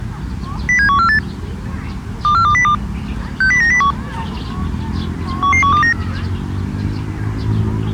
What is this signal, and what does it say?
Five-tone selective call (CCIR), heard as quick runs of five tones, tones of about 100 ms, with the noise of a park. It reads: 07148 24202 60901 11129